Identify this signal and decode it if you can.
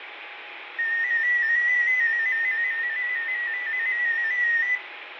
Multi-tone FSK (Olivia or MFSK type), about 250 Hz wide, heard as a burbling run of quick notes, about 15.625 baud, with radio static and room echo.